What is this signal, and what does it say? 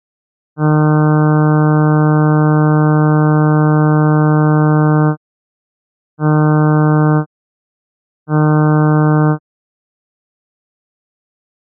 Ship horn signal, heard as a ship's horn, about 150 Hz. 1 long, 2 short. At sea: a vessel in fog that is sailing, fishing, towing or hampered.